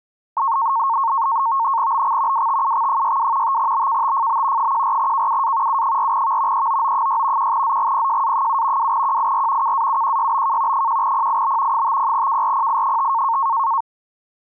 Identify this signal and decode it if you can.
NAVTEX (SITOR-B), 100 baud, 170 Hz shift, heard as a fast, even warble, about 1000 Hz centre. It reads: BX WTUX62 5BKTFB 14KUA U4V EOO6 1ZGPJA7 2QIR KAUQYBK 1PIB 50KRPI5